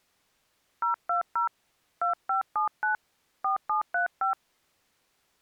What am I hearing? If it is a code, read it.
DTMF, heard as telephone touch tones, dialled by hand, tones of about 120 ms. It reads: 020 2579 4735